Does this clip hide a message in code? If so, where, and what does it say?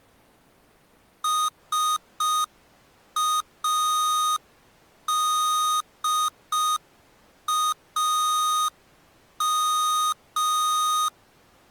Yes: Morse code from 1.2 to 11.1 s, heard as electronic beeps, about 5 wpm, 1240 Hz. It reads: SADAM